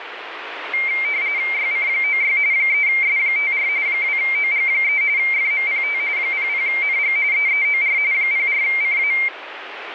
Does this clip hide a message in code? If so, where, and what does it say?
Yes: RTTY (45.45 baud, 170 Hz shift) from 0.7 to 9.3 s, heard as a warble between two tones, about 2200 Hz centre, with radio static. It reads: YC96 3S54 2OG3 FMPT 00NG EEOR 04CA